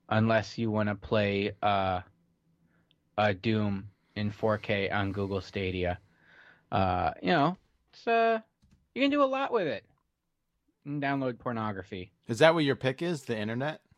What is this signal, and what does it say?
Speech in English. There is no code.